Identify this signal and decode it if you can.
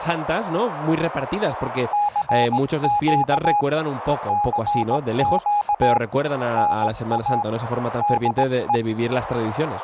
Morse code, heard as a keyed tone, hand-sent with a straight key, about 18 wpm, 830 Hz, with radio static and speech in Spanish. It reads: CQ CQ NA DE